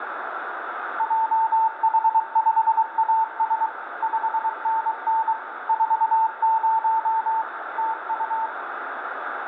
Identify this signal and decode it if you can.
Morse code, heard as a keyed tone, machine-sent, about 23 wpm, 890 Hz, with radio static and room echo. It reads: JH5AS 5NN 40 TU